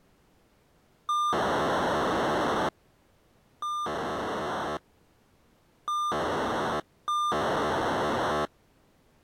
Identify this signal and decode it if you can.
POCSAG pager data (2400 baud), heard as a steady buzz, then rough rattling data.